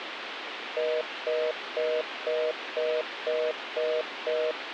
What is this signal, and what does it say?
Telephone call progress tone (North American plan), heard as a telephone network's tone, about 480, 620 Hz, 0.25 s on and 0.25 s off, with phone line noise. Congestion tone.